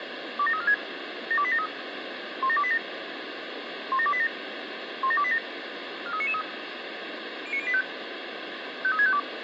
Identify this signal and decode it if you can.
Five-tone selective call (ZVEI), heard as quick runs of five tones, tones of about 70 ms, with radio hiss. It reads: 27346 72873 17287 17287 17287 43993 09085 53652